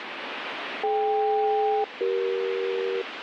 Aircraft SELCAL, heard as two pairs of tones, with radio static. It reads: DK-CE